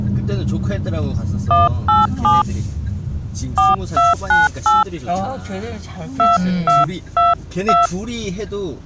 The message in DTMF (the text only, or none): 187 4298 2222